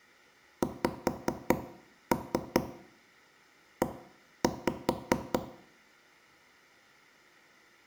Tap code, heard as taps on a table, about 4 knocks a second, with room echo. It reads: XE